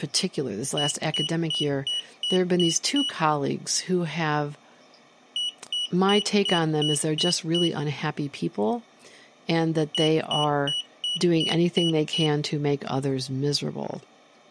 Beep code, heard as a piezo beeper, played three times, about 2950 Hz, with speech in English. 7 short. In AMI BIOS tables: virtual mode exception error; in Dell tables: processor failure.